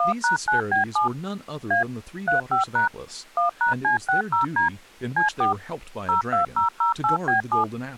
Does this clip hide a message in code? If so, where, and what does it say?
Yes: DTMF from 0.0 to 7.6 s, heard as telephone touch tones, dialled by machine, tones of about 120 ms, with speech in English. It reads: 1#9B7 A 35# 1#C60D C4 02008B7